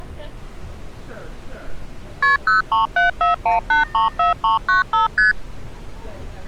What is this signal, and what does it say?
Multi-frequency trunk signalling (R1, as on North American trunks), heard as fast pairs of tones, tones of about 140 ms, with street noise. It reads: KP 03741834395 ST